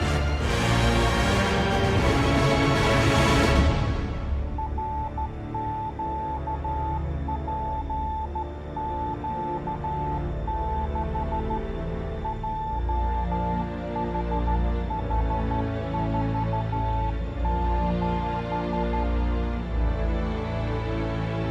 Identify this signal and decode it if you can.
Morse code, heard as a keyed tone, hand-sent with a straight key, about 13 wpm, 880 Hz, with room echo. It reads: RQPQ6 JHH47